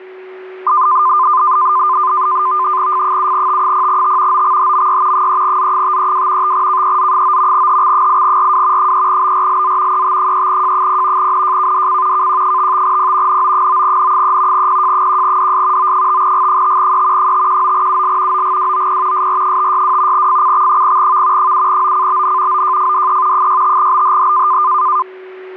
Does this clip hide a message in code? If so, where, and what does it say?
Yes: NAVTEX (SITOR-B), 100 baud, 170 Hz shift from 0.7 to 25.0 s, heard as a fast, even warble, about 1120 Hz centre, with a steady whistle near 370 Hz. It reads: F7T0T OXHMY 3Z532 5KEZ9 HX8RW 3BRLZ ET3J0 NJKDC KQ55P NO9N3 PJ1DS O5G5E 519UL OGWOP SR562 FCX0V 7OCBN OJFDE 65BHH